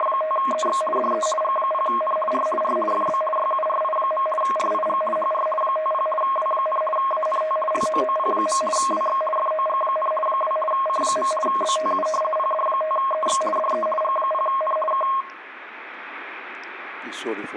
RTTY (50 baud, 450 Hz shift), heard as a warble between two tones, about 850 Hz centre, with room echo. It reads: … DE G0N R R FB YURI. RIG HR 50 W, ANT LOOP. WX FOG, 2 C. BTU PD5EX DE G0N K